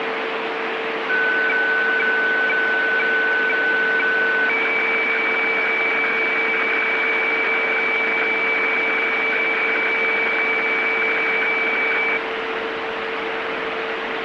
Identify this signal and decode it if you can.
Weather fax (radiofax), 120 lines a minute, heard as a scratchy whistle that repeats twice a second, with heavy radio static.